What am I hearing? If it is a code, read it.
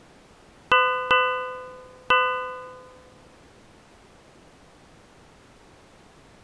Ship's bell, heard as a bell. 3. Three half-hours of the watch have passed.